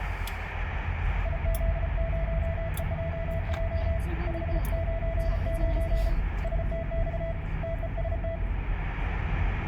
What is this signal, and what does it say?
Morse code, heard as a keyed tone, hand-sent with a paddle, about 34 wpm, 660 Hz, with radio static, room echo and the noise inside a car. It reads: IZ0EJJ 599 STX TEST